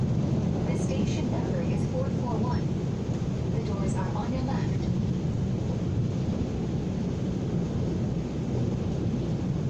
The noise inside a subway train. There is no code.